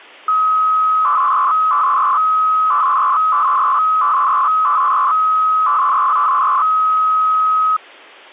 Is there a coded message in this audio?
Yes: 300-baud modem data (Bell 103 tones) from 0.3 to 7.8 s, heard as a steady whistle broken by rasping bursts, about 300 baud, 200 Hz shift.